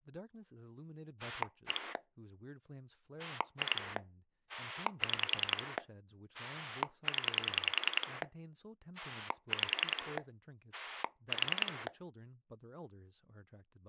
Pulse dialling, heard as a rotary dial, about 10 pulses a second, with speech in English. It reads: 1 2 6 0 5 4